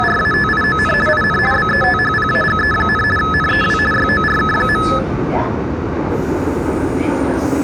RTTY (50 baud, 450 Hz shift), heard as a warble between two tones, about 1500 Hz centre, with the noise inside a subway train. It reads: … IN BETHPAGE, NEW YORK.